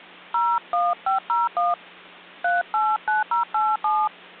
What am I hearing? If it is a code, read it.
DTMF, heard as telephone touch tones, dialled by hand, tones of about 190 ms, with hum. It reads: 01501 389087